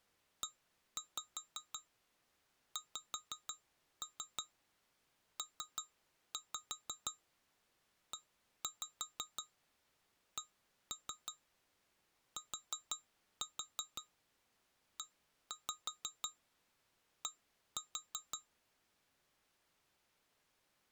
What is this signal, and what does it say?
Tap code, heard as taps on glass, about 6 knocks a second. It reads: EXPECTED